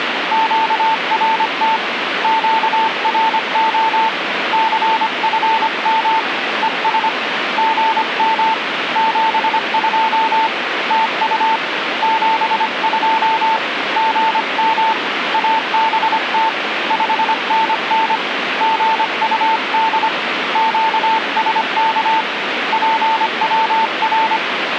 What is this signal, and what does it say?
Morse code, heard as a keyed tone, hand-sent with a paddle, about 25 wpm, 890 Hz, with radio static. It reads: QRT QRO CFM ES GM 72 TU 72 GM ABT 5NN GUD QSK PWR